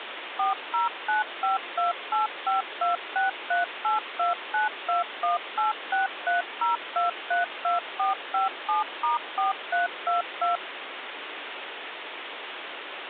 DTMF, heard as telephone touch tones, dialled by machine, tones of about 140 ms, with phone line noise. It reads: 4095285263829218630232457*4322